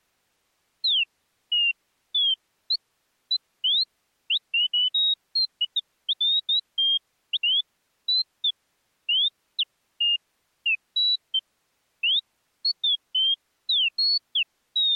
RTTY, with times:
none

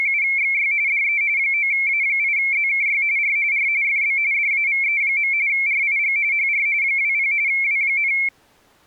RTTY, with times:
0.0-0.7 …
0.9-1.2 DE
1.4-3.0 9A8ZKY
3.2-3.4 R
3.5-3.7 R
3.8-4.2 FB
4.3-5.3 DAVE.
5.5-6.2 RIG
6.3-6.7 HR
6.8-7.3 20
7.5-8.1 W,

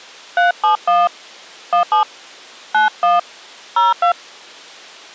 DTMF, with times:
0.4-1.1 371
1.7-2.0 17
2.7-3.2 91
3.8-4.1 02

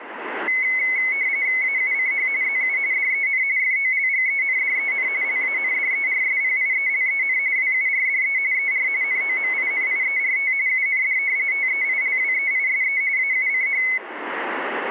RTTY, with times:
1.6-2.3 AUCH
2.4-2.8 ZU
2.9-3.4 DEN
3.6-5.1 FOLGENDEN
5.2-7.4 LANDERSPIELEN
7.6-8.4 WURDE
8.5-8.9 ER
9.0-10.5 NOMINIERT
10.7-11.2 UND
11.5-13.0 TEILWEISE
13.2-13.8 AUCH

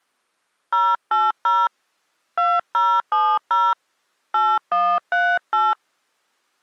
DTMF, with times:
0.7-1.7 080
2.4-3.7 2070
4.3-5.7 8138

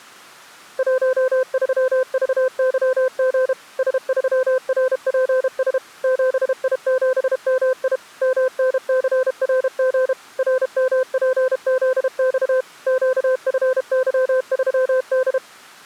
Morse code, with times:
0.8-3.5 13VYG
3.8-5.8 S3RPS
6.0-8.0 7I7MI
8.2-10.1 MNCRG
10.4-12.6 RMPZX
12.9-15.4 QFY3D

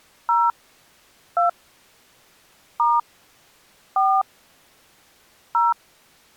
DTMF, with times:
0.3-0.5 0
1.4-1.5 2
2.8-3.0 *
4.0-4.2 4
5.5-5.7 0

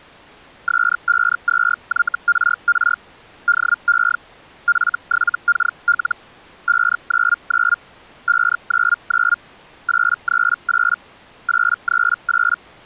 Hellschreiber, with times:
0.7-3.0 S52YRR
3.5-4.2 DE
4.7-6.2 F7KL
6.7-7.8 599
8.3-9.4 599
9.9-11.0 838
11.5-12.6 838

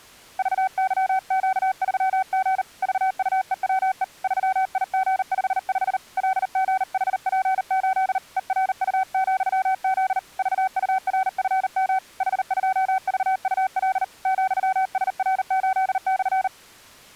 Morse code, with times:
0.4-2.6 VYQ3G
2.8-4.0 VUEWE
4.2-6.0 3IG55
6.2-8.2 LGHP8
8.4-10.2 ERU,Z
10.4-12.0 VURFM
12.2-14.0 H2VUL
14.3-16.5 ,SR8/

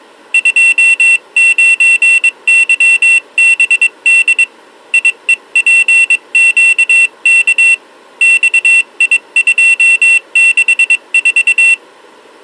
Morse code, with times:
0.3-4.4 29YBD
4.9-7.7 IEPQK
8.2-11.7 XI264

